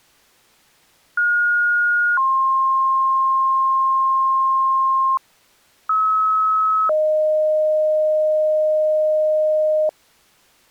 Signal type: two-tone page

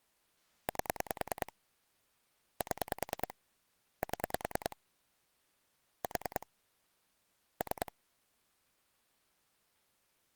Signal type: pulse dialling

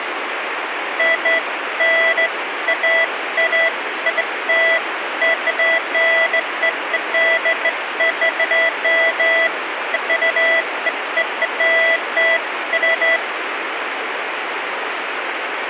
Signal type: none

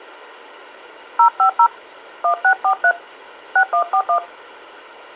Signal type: DTMF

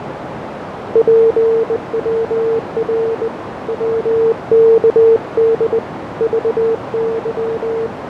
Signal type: Morse code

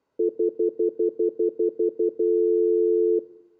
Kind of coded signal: telephone call progress tone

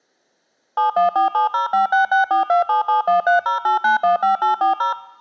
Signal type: DTMF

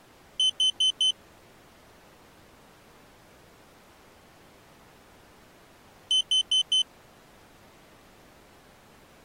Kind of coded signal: alarm pattern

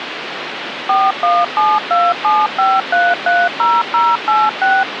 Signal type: DTMF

